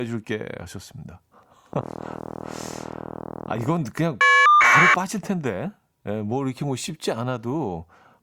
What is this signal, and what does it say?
Caller ID data burst, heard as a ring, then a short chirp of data, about 1200 baud, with speech in Korean.